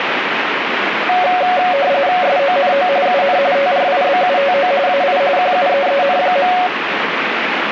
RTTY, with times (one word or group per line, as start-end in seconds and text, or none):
2.2-2.9 SONO
3.1-3.4 UN
3.6-4.7 TRIBUTO
4.9-5.2 AI
5.4-6.5 QUEEN.